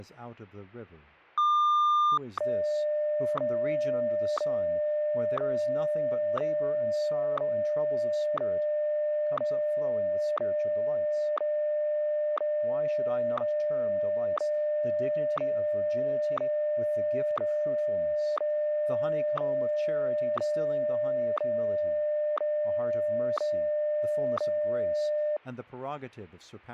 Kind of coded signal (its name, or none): radio time signal